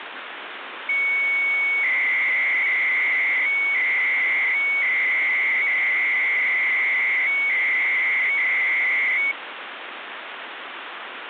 300-baud modem data (Bell 103 tones), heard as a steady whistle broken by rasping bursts, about 300 baud, 200 Hz shift, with phone line noise.